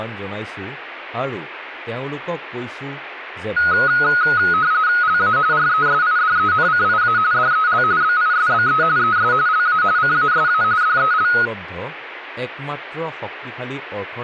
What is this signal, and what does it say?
RTTY (45.45 baud, 170 Hz shift), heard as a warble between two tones, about 1360 Hz centre, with radio static and speech in Assamese. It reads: LA RESIDENCIA DEL BISBE ES LA CASA DEL